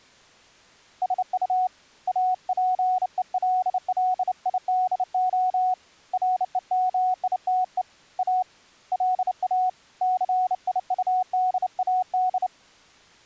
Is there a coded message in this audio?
Yes: Morse code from 1.0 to 12.5 s, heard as a keyed tone, hand-sent with a bug key, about 29 wpm, 740 Hz. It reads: SU APELLIDO REMITE A LA CIUDAD